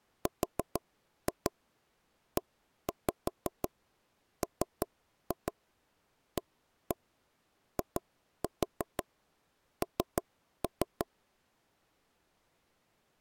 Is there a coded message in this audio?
Yes: tap code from 0.3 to 11.1 s, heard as taps on a table, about 6 knocks a second. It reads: REMAIN